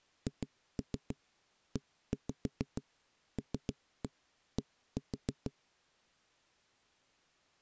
Tap code, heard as knocks on a wall, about 6 knocks a second. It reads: HELD